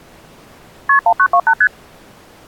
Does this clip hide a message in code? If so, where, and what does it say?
Yes: multi-frequency trunk signalling (R1, as on North American trunks) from 0.9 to 1.7 s, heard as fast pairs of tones, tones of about 70 ms. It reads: KP 1928 ST